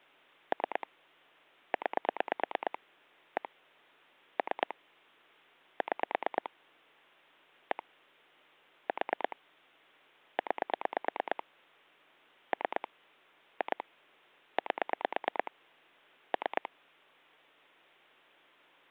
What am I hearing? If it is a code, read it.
Pulse dialling, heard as clicks on a phone line, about 9 pulses a second. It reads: 3 9 1 3 6 1 4 9 3 2 8 3